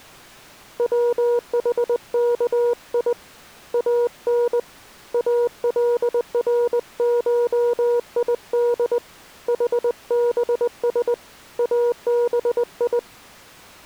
Morse code (Arabic alphabet), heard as a keyed tone, hand-sent with a paddle, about 20 wpm, 480 Hz. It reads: وحكي ان الرشيد حبس ابي